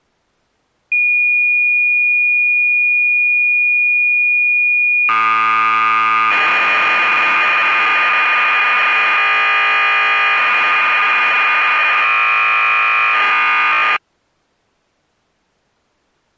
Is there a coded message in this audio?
Yes: cassette data (Kansas City type), 1200 baud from 0.9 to 14.0 s, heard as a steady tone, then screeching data.